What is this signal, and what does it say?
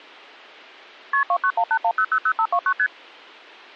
Multi-frequency trunk signalling (R1, as on North American trunks), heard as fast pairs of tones, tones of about 70 ms. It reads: KP 29181000529 ST